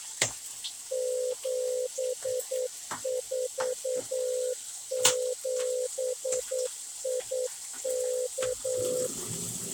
Morse code, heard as a keyed tone, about 9 wpm, 500 Hz, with kitchen noise. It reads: 747IK